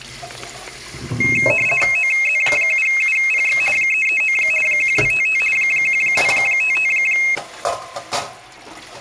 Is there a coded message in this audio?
Yes: RTTY (50 baud, 450 Hz shift) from 1.2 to 7.4 s, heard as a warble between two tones, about 2350 Hz centre, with static crashes and kitchen noise. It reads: OZ7UPX 339 1255 1255